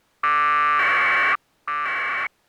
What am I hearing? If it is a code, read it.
Packet radio (AX.25, as in APRS), 1200 baud, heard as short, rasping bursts.